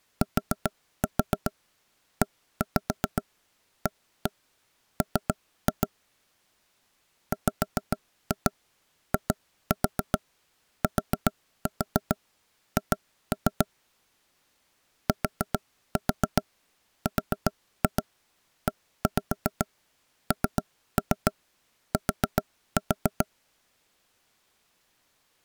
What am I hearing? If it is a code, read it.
Tap code, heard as knocks on wood, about 7 knocks a second. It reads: TEAM WITH TRENT